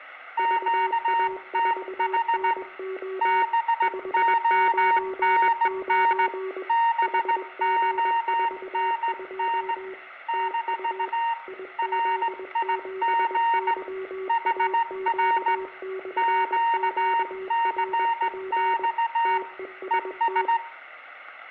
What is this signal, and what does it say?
Morse code, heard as two keyed tones, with room echo. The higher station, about 17 wpm, 930 Hz: QTH BONN BONN - RIG HR QCX ES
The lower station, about 21 wpm, 380 Hz: VA4NO 599 HG42 TU IZ7YAQ/QRP TEST